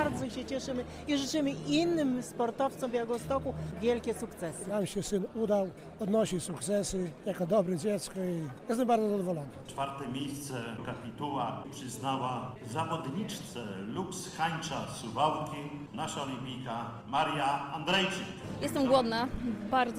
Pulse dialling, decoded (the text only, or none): none